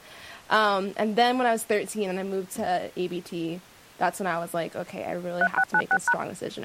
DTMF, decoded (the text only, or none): 3696#